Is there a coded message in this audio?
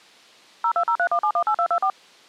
Yes: DTMF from 0.6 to 1.9 s, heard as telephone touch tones, dialled by machine, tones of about 80 ms. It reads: 02031718224